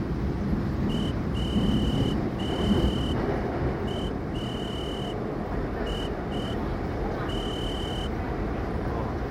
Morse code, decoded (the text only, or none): WAIT